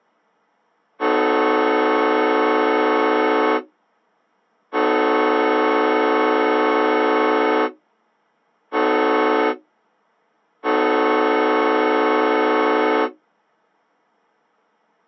Train horn signal, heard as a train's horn. 2 long, 1 short, 1 long. On North American railways: approaching a public crossing.